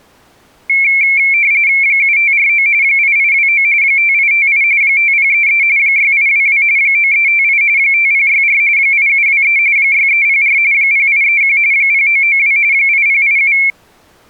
RTTY (45.45 baud, 170 Hz shift), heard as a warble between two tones, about 2250 Hz centre. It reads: 7549 8829 5858 5033 6822 9358 5064 8723 6304 0831 0992 8087